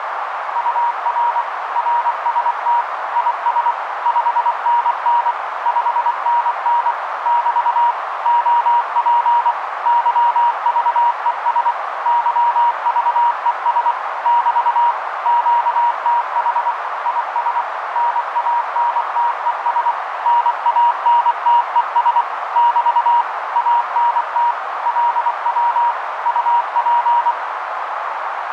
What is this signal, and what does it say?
Morse code, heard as a keyed tone, machine-sent, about 24 wpm, 950 Hz, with radio static and a narrow filter. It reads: UR RST IS 5NN 5NN <BT> OP YVES YVES <BT> QTH IS NANTES NANTES <BT> ANT LW UP